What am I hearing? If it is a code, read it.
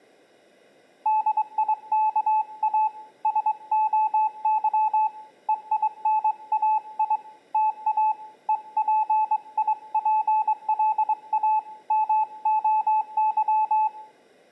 Morse code (Greek alphabet), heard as a keyed tone, hand-sent with a straight key, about 22 wpm, 860 Hz, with room echo. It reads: ΔΙΚΑ ΣΟΥ ΕΙΝΑΙ ΤΑ ΕΠΙΠΛΑ ΜΟΥ